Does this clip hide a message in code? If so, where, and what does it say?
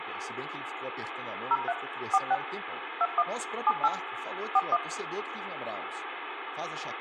Yes: DTMF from 1.5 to 4.8 s, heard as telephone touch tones, dialled by machine, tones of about 40 ms, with phone line noise, room echo and speech in Portuguese. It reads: 03 46 21 78 41